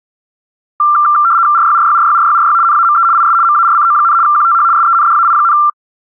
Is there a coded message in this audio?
Yes: RTTY (75 baud, 170 Hz shift) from 0.8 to 5.7 s, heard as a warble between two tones, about 1270 Hz centre. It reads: RYRYRYRYRY NAME IS MARCO, QTH SENDAI,